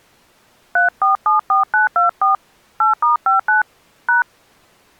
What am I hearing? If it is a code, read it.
DTMF, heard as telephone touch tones, dialled by hand, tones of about 140 ms. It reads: 3474924 8*59 #